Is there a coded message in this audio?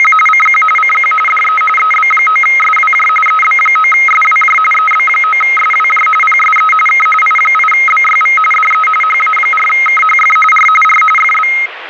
Yes: RTTY (45.45 baud, 850 Hz shift) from 0.0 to 11.7 s, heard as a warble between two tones, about 1700 Hz centre, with radio static. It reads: … CQ CQ DE EB9SWJ EB9SWJ EB9SWJ PSE K I8BYV DE HA4KHF R R FB